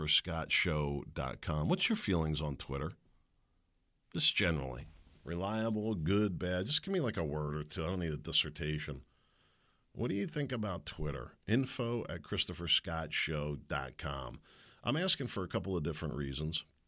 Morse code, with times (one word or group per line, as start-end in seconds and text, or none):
none